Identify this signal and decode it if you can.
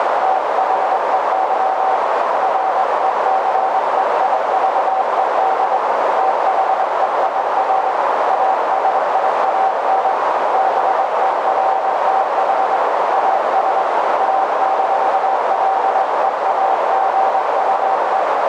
Morse code, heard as a keyed tone, hand-sent with a straight key, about 22 wpm, 770 Hz, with heavy radio static and a narrow filter. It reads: THEY RECEIVED THEIR ASIAN BERTH AS A-LEAGUE